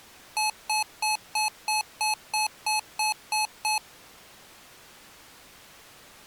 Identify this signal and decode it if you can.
Beep code, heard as beeps from a small speaker, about 860 Hz. 11 short. In AMI BIOS tables: cache memory error.